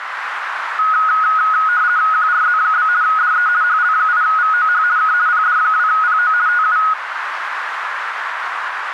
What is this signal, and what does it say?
RTTY (50 baud, 170 Hz shift), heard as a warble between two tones, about 1360 Hz centre, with radio static and a narrow filter. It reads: QRZ? DE HL8VOH K PD2PO TU